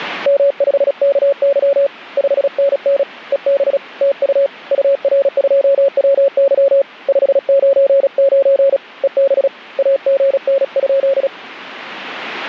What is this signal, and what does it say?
Morse code, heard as a keyed tone, hand-sent with a paddle, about 36 wpm, 550 Hz. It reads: M5KY 5NN EB TU UR2WY 599 EB AGN?